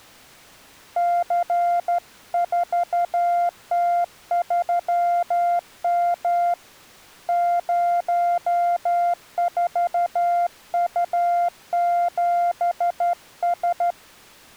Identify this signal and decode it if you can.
Morse code, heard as a keyed tone, hand-sent with a straight key, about 13 wpm, 700 Hz. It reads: C4T3M 04U7S